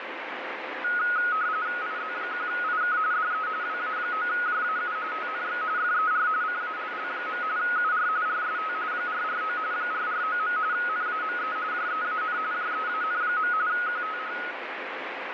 RTTY (45.45 baud, 170 Hz shift), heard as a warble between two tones, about 1360 Hz centre, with radio static. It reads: IZ1IK DE WA9JAU TNX FER CALL. UR RST 449 449. NAME JEAN JEAN. QTH